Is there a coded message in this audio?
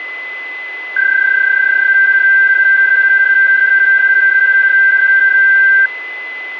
Yes: PSK31 (31.25 baud) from 1.0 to 5.9 s, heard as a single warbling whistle, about 1550 Hz, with a steady whistle near 2020 Hz.